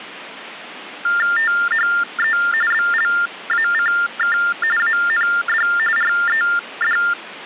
TTY/TDD text telephone tones (45.45 baud Baudot), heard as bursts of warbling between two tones, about 400 Hz shift, 1600 Hz centre, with phone line noise. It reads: THE BLACK AND RED